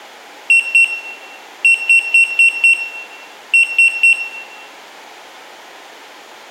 Beep code, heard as a piezo beeper, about 2700 Hz, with room echo. 2-5-3.